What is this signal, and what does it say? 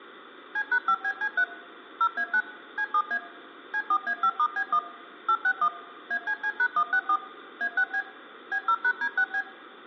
DTMF, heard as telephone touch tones, dialled by machine, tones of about 70 ms. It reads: C#5BC3 0A9 C7A C4A5*B1 861 ACC#164 A6B B0#D6B